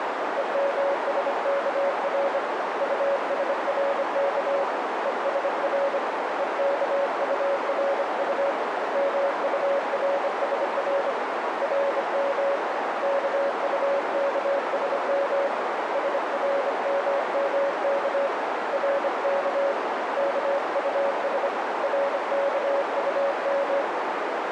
Morse code, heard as a keyed tone, hand-sent with a bug key, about 25 wpm, 560 Hz, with heavy radio static and a narrow filter. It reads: EMSKR USRK ESR EKURU MURSR RM KUKSM SRMMK RK KUS RKUM